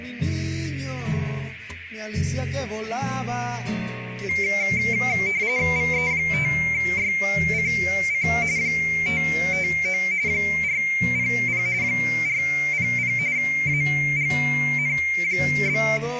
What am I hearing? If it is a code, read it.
RTTY (45.45 baud, 170 Hz shift), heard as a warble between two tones, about 2200 Hz centre, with radio static. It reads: VE5YCC 559 400 400 AGN?